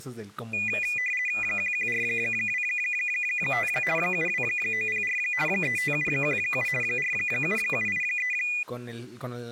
RTTY (50 baud, 450 Hz shift), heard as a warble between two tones, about 2200 Hz centre, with speech in Spanish. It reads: 11425 72904 35717 47783